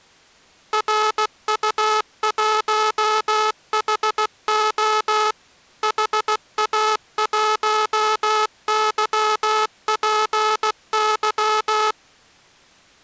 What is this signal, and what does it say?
Morse code, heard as a buzzer, machine-sent, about 16 wpm. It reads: RU1HO HA1YPY